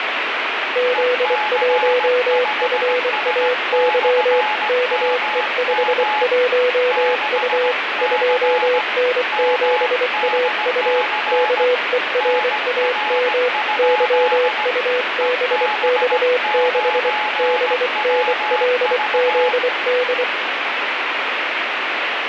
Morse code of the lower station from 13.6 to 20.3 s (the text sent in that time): YUBX6 BNLZD